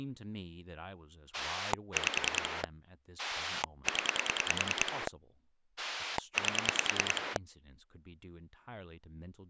Pulse dialling, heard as a rotary dial, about 10 pulses a second, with speech in English. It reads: 5 0 8